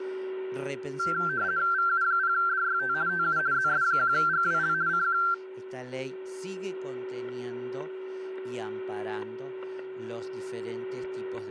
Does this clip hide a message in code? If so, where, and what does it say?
Yes: RTTY (50 baud, 170 Hz shift) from 1.0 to 5.3 s, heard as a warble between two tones, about 1460 Hz centre, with static crashes and a steady whistle near 380 Hz. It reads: VU0DYT TU ZS1GWL CQ